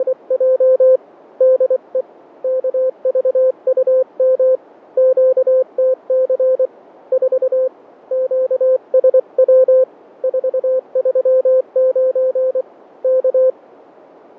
Morse code, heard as a keyed tone, hand-sent with a paddle, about 24 wpm, 520 Hz. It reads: … DE KVUM QTC 4 QSW 439 K